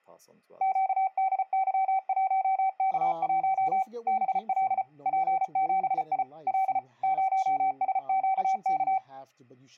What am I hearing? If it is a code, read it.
Morse code, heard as a keyed tone, machine-sent, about 34 wpm, 770 Hz, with speech in English. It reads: QDY1K1 BL P7I L 0SQK